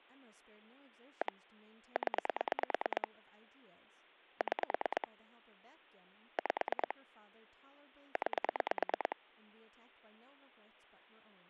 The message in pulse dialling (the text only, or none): 1 0 6 5 9